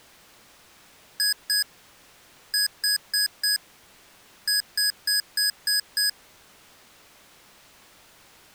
Beep code, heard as beeps from a small speaker, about 1650 Hz. 2-4-6.